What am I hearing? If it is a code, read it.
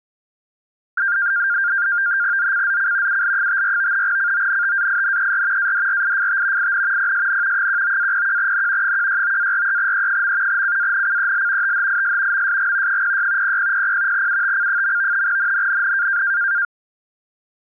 NAVTEX (SITOR-B), 100 baud, 170 Hz shift, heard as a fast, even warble, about 1500 Hz centre. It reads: ZCZC UL54 CONTAINER ADRIFT IN PSN 19-01N 169-43E. CANCEL THIS MSG 06 0000 UTC. NNNN